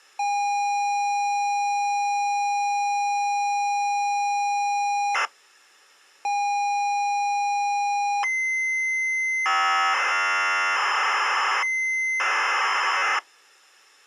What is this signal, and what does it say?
ZX Spectrum tape loading, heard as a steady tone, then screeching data.